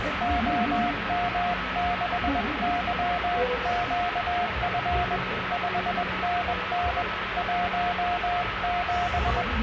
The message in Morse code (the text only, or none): OM6YQF 5NN 17